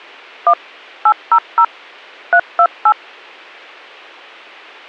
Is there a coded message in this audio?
Yes: DTMF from 0.5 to 2.9 s, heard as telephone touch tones, dialled by machine, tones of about 70 ms. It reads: 1 800 328